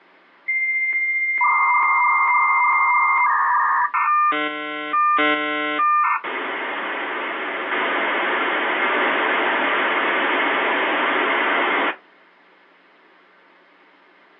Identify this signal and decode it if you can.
Dial-up modem handshake (V.34 or later), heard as a whistle, warbles, then hiss.